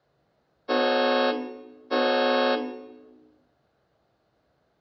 Train horn signal, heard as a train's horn, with room echo. 2 short. On North American railways: a signal is acknowledged.